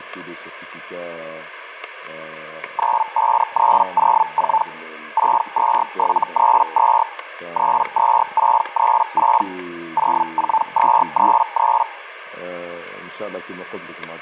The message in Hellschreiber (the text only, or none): 95304 62732 32636 04233